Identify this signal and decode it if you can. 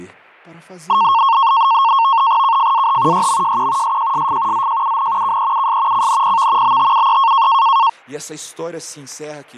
NAVTEX (SITOR-B), 100 baud, 170 Hz shift, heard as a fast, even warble, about 1000 Hz centre, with static crashes and speech in Portuguese. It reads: KFAH YMJQ SJSF ZJUN KEUS CNPV BTUE